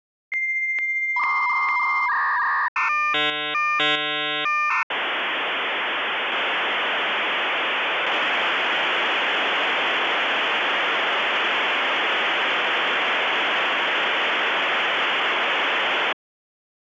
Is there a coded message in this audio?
Yes: dial-up modem handshake (V.34 or later) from 0.3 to 16.1 s, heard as a whistle, warbles, then hiss.